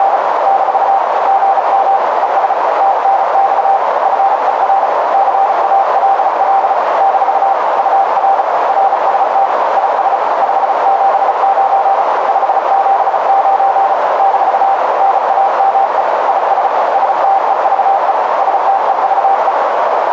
Morse code, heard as a keyed tone, hand-sent with a bug key, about 35 wpm, 780 Hz, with heavy radio static and a narrow filter. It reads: … - GM ES TNX FER CALL - UR RST IS 579 579 - NAME IS STEVE STEVE